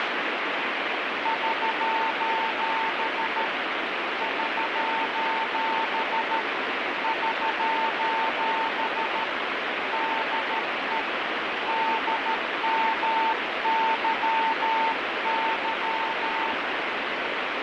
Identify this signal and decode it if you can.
Morse code, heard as a keyed tone, hand-sent with a paddle, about 13 wpm, 900 Hz, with heavy radio static. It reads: <SOS> <SOS> <SOS> DE DMYY